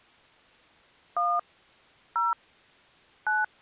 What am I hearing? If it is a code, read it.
DTMF, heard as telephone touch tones, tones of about 190 ms. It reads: 1 0 9